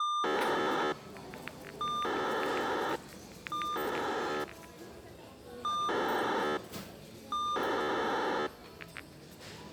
POCSAG pager data (2400 baud), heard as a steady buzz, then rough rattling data, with the noise of a crowd indoors.